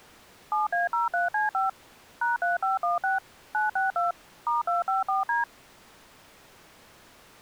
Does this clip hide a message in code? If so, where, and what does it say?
Yes: DTMF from 0.5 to 5.4 s, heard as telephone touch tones, dialled by machine, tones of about 150 ms. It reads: 7A03C5 #3516 962 *254D